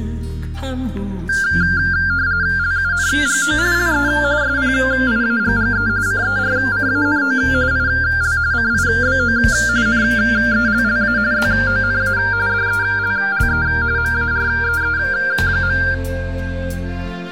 RTTY (45.45 baud, 170 Hz shift), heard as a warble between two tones, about 1490 Hz centre, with static crashes. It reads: LUNGO LE SPIAGGE CERCANO IL CIBO NELLA ZONA DELLE MAREE.